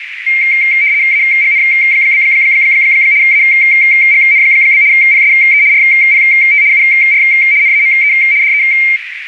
RTTY (75 baud, 170 Hz shift), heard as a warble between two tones, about 2200 Hz centre, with radio static and a narrow filter. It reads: AGN? AGN? PSE RPT UR NAME DE